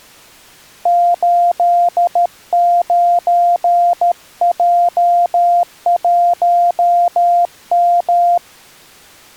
Morse code, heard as a keyed tone, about 13 wpm, 700 Hz. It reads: 89J1M